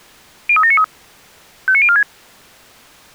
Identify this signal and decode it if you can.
Five-tone selective call (ZVEI), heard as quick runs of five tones, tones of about 70 ms. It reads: 03793 59046